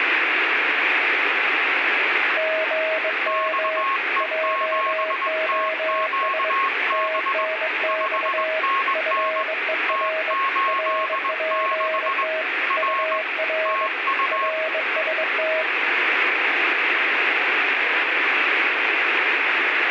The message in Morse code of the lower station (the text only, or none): GM JOS TNX FER RPT UR RST